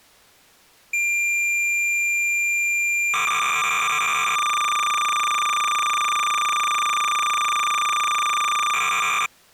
Cassette data (Kansas City type), 300 baud, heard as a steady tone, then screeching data.